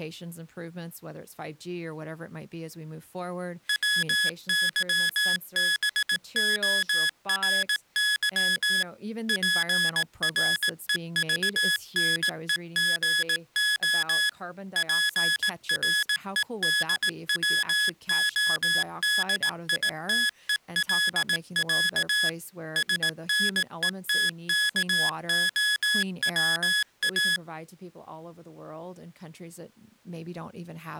Morse code (Russian alphabet), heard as electronic beeps, machine-sent, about 18 wpm, 1700 Hz, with speech in English. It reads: ВЫБОРЫ ПРЕЖНЕГО ПРЕДВОДИТЕЛЯ СНЕТКОВА